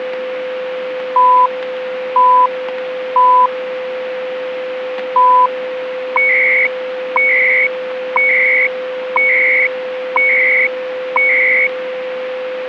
Radio time signal (CHU, Canada), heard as beeps and data bursts, one a second, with radio static and a steady whistle near 510 Hz.